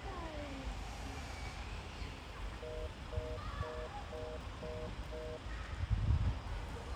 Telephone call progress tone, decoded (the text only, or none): congestion tone